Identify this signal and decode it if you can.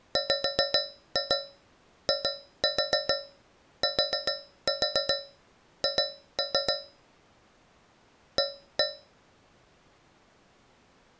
Tap code, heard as taps on a metal pipe, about 7 knocks a second. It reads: WITH A